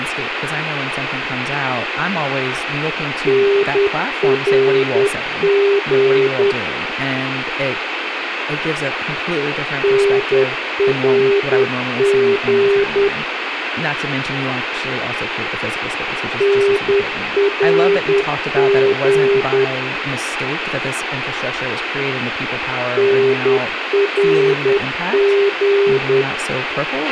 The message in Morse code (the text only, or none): NRG NRG NRG NRG